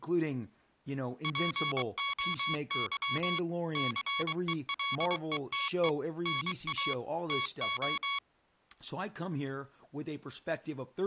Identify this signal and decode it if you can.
Morse code (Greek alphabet), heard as electronic beeps, machine-sent, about 23 wpm, 1120 Hz, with speech in English. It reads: ΠΟΥ ΘΕΛΕΤΕ ΝΑ ΤΟ